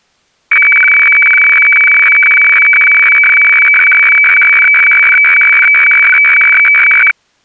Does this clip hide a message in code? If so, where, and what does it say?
Yes: weather fax (radiofax), 120 lines a minute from 0.5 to 7.1 s, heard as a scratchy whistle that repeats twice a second.